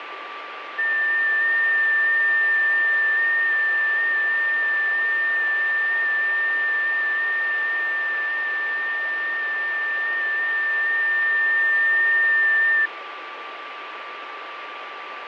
FT8 (one signal), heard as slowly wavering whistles, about 6.25 baud, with radio static and a steady whistle near 1170 Hz.